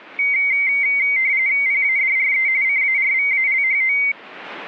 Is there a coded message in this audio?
Yes: RTTY (45.45 baud, 170 Hz shift) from 0.2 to 4.1 s, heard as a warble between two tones, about 2150 Hz centre. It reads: PADRE CARVALHO